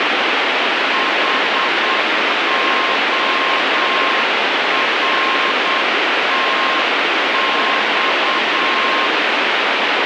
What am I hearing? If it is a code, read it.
Morse code, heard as a keyed tone, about 8 wpm, 1060 Hz, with heavy radio static. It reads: HORTX